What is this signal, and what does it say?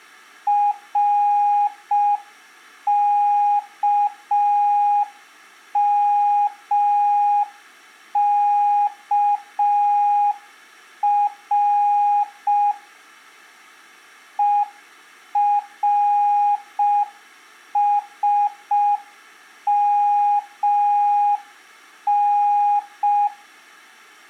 Morse code, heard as a keyed tone, machine-sent, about 5 wpm, 820 Hz. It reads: RKMKR ERSMN